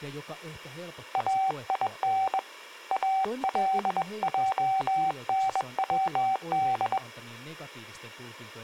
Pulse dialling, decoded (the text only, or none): none